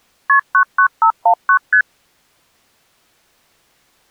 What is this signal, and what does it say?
Multi-frequency trunk signalling (R1, as on North American trunks), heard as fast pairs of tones, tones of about 80 ms. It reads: KP 99519 ST